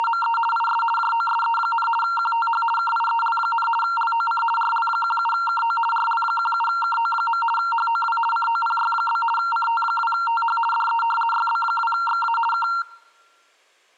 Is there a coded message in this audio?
Yes: RTTY (50 baud, 450 Hz shift) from 0.0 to 12.8 s, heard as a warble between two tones, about 1150 Hz centre. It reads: … IS JOSE, QTH KIEL, LOC RL17KO RL17KO. HOW COPY? CT2TH DE YB2XA K